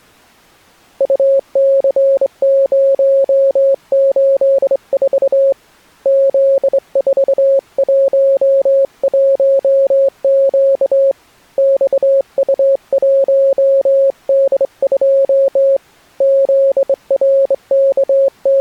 Morse code, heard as a keyed tone, hand-sent with a straight key, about 24 wpm, 540 Hz. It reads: UC084 Z411Q XU1D2 …